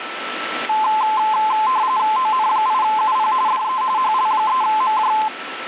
RTTY (45.45 baud, 170 Hz shift), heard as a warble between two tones, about 950 Hz centre, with radio static and a steady whistle near 1330 Hz. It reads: ON8UP DE HL3MJ